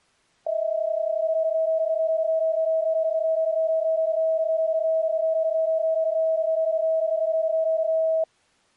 PSK31 (31.25 baud), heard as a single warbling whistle, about 640 Hz.